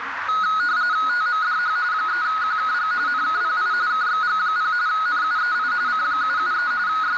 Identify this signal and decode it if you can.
RTTY (45.45 baud, 170 Hz shift), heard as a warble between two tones, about 1360 Hz centre, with radio static, a narrow filter and the noise of a restaurant. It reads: TMDH 3QKG NKPI KXG0 NUEI C773 …